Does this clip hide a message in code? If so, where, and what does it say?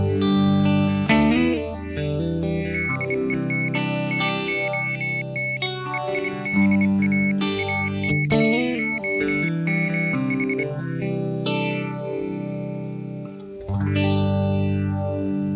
Yes: Morse code (Greek alphabet) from 2.7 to 10.7 s, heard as a high beeper, hand-sent with a bug key, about 25 wpm, 2200 Hz. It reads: ΔΕΝ ΤΟΝ ΕΙΔΑ ΑΚΟΜΗ